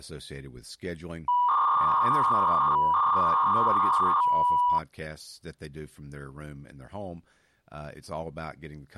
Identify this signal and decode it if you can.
300-baud modem data (V.21 tones), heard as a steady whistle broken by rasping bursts, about 300 baud, 200 Hz shift, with speech in English.